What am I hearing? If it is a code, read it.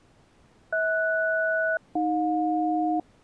Aircraft SELCAL, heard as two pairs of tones. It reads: HS-AJ